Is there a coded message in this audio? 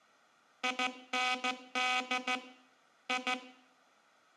Yes: Morse code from 0.6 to 3.4 s, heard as a buzzer, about 14 wpm, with room echo. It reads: IND I